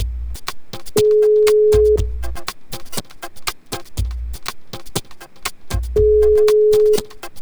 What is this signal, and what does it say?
Telephone call progress tone (single-tone plan, as in most of Europe), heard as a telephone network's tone, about 420 Hz, 1 s on and 4 s off, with room echo. Ringback tone.